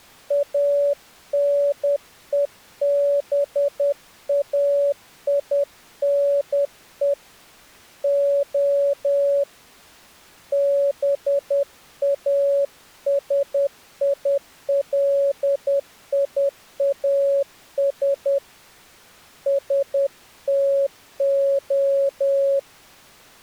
Morse code (Greek alphabet), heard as a keyed tone, hand-sent with a paddle, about 10 wpm, 560 Hz. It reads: ΑΝΕΒΑΙΝΕ Ο ΒΑΣΙΛΙΑΣ ΣΤΟ